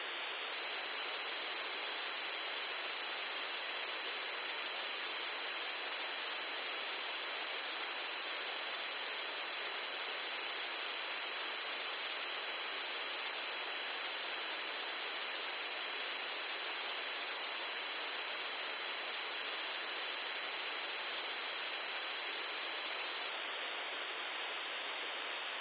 A steady tone. There is no code.